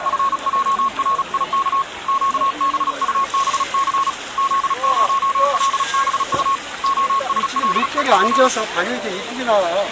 Morse code, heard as a keyed tone, hand-sent with a paddle, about 36 wpm, 1090 Hz, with the noise of a park. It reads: FJRIK QBUBC Z0LBU OSLEP